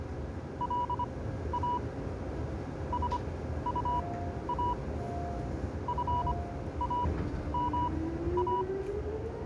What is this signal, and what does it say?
Morse code, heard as a keyed tone, machine-sent, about 25 wpm, spaced as for 13 wpm, 980 Hz, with the noise inside a subway train. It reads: LA SUA FAMA